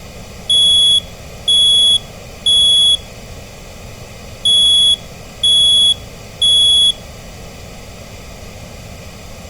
Alarm pattern, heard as an alarm's beeps, played twice, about 3350 Hz. Temporal three. Smoke or fire, evacuate.